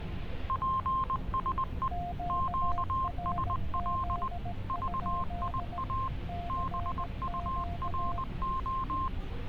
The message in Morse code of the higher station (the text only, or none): PSE QSL VIA BURO